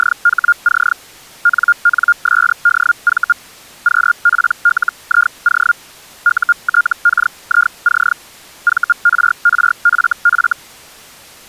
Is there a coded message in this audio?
Yes: Hellschreiber (Feld-Hell, 122.5 baud) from 0.0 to 10.5 s, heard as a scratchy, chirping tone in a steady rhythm, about 1410 Hz. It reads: … NNSDV QPLIO UTKIC VRRFF